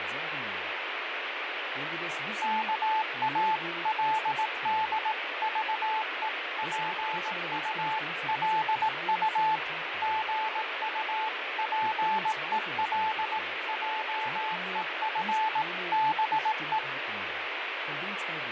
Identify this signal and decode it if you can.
Morse code (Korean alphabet), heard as a keyed tone, machine-sent, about 18 wpm, 870 Hz, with radio static, fading and speech in German. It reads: 오그라지기 시작한다